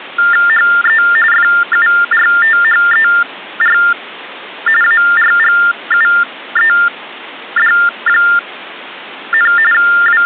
TTY/TDD text telephone tones (45.45 baud Baudot), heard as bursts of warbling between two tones, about 400 Hz shift, 1600 Hz centre. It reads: HE FURTHER ARGUED, …